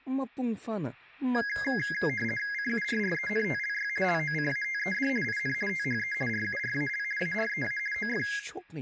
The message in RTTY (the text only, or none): CURRENTLY LOCATED IN THE RURAL AREA OF